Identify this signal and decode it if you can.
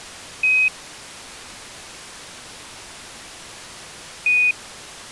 Quindar tones, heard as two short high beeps.